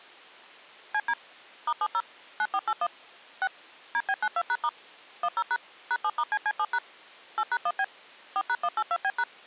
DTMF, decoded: CD *70 9481 6 DB92#* 10# #7*CC7# 8#1B 4#182B#

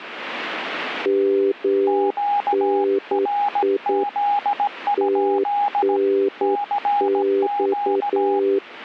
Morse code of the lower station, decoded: MNI TNX

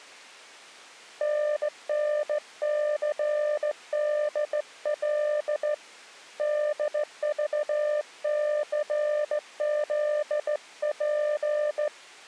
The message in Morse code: NNCDL DVCZP

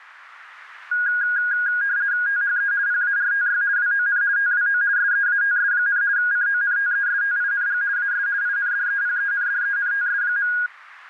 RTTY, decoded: THE PARTY WON TWO SEATS, CONTESTING AS INDEPENDENTS.

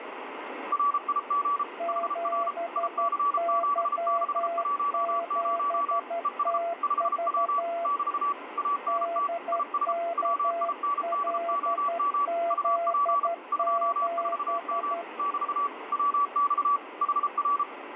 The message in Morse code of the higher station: RIG HR IC7610 ES 5W <BT> ANT IS WINDOM UP 24M <BT> WX HR

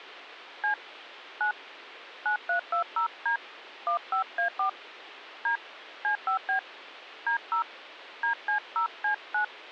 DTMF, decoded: C 9 9320D 15A4 D C5B D0 DC0C9

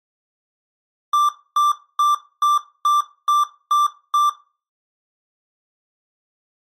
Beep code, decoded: 8 short

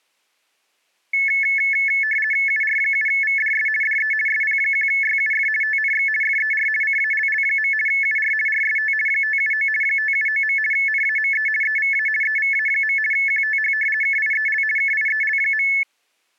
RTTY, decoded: UR7VDS DE SP1YUF TNX FER CALL. UR RST 579 579. NAME EVA EVA. QTH KIEL KIEL.

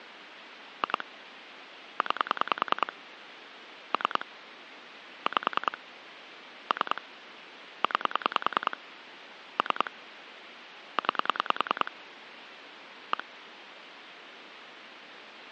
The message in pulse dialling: 2 9 3 5 3 9 3 9 1

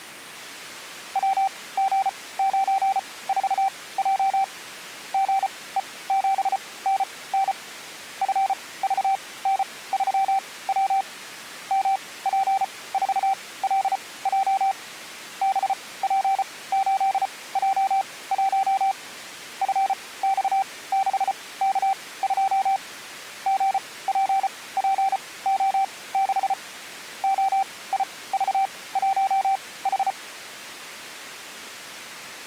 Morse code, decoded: WG94J GE7NN FVN3W MP4LJ BP8J1 FX6K2 GPPO6 OIV1H

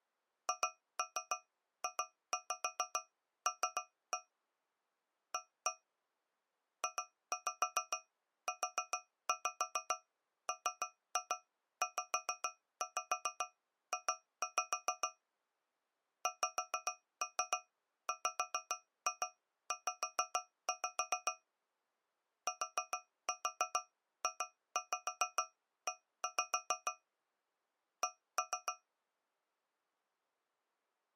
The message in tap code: HJL A JUMZJ XWZ TJE C

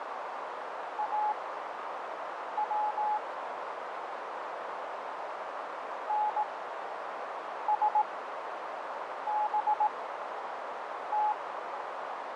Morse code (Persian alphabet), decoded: او نسبت

